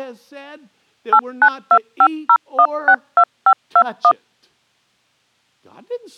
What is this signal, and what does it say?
DTMF, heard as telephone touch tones, dialled by machine, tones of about 70 ms, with speech in English. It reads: 89250162521